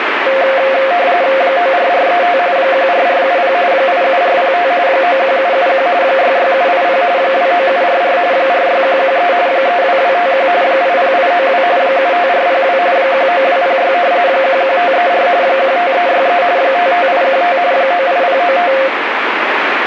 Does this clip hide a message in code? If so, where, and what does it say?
Yes: RTTY (45.45 baud, 170 Hz shift) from 0.3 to 18.9 s, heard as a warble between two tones, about 620 Hz centre, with radio static. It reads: 94435 14470 87405 91771 66780 29744 46113 32251 80892 75402 19206 11534 15363 55815 98095